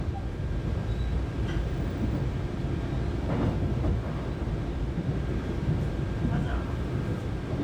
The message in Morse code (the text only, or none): none